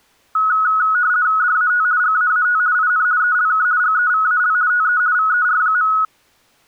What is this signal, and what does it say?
RTTY (50 baud, 170 Hz shift), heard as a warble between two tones, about 1370 Hz centre. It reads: DAT GAAT IN ELK GEVAL TE VER.